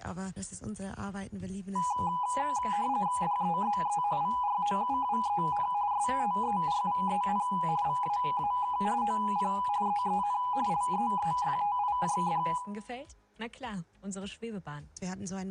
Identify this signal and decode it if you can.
RTTY (45.45 baud, 170 Hz shift), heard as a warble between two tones, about 910 Hz centre, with room echo. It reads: DEZE VROUWEN STERVEN VAAK OP EEN LEEFTIJD